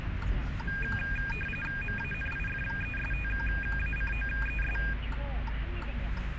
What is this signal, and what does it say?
RTTY (45.45 baud, 850 Hz shift), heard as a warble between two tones, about 2050 Hz centre, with radio static and the noise inside a car. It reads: MANIFESTACOES